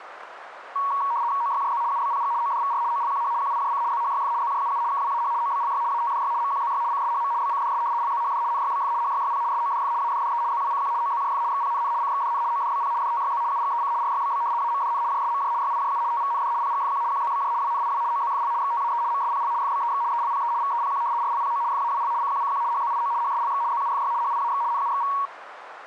RTTY (75 baud, 170 Hz shift), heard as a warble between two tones, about 1030 Hz centre, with radio static. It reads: OYJZ UBPG ODVR OLQH QIJC ZHYF ZJUU KWAH OBLY ATDY MQZY CSHM BCDS LZHD NYBF HYYP SODF ADDE ZWCQ OZJF XPNN CXDN ODBP DTYZ UGEC RYBB AMDN JSMJ YIJU TVND PGFQ QZBJ WNIW OZFL XTAE MSPL FBEX ELPE VEPQ RLPO FAWL CQCQ HZIO HSLX ZUFY HIAX NUXV